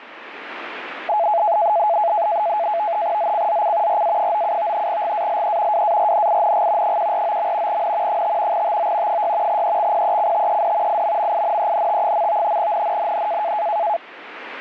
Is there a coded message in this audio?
Yes: NAVTEX (SITOR-B), 100 baud, 170 Hz shift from 1.1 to 14.0 s, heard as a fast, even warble, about 760 Hz centre, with radio static. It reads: ZCZC RA97 GALE WARNING 149. N 5 TO 6 EXPECTED IMMINENT. NNNN